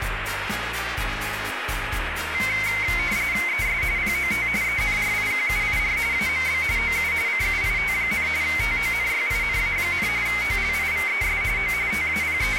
RTTY (45.45 baud, 170 Hz shift), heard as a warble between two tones, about 2150 Hz centre, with radio static. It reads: ES POT ENRIQUIR AMB OU CUIT, TONYINA, OLIVES O …